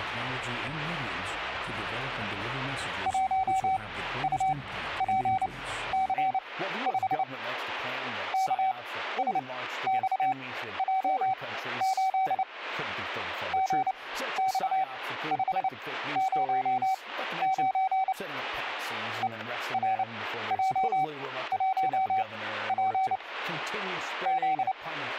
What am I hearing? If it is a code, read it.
Morse code, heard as a keyed tone, machine-sent, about 29 wpm, spaced as for 14 wpm, 760 Hz, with static crashes. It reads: 1UPC5 KSXJ8 GX509 ERJ1P …